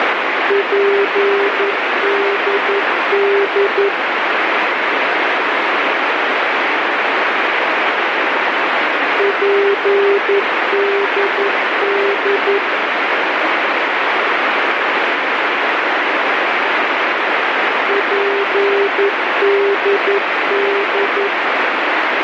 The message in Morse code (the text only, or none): PDD PDD PDD